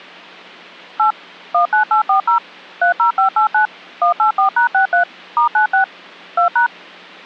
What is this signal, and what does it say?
DTMF, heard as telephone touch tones, dialled by machine, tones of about 110 ms. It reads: 8 19840 30589 184#63 *96 2#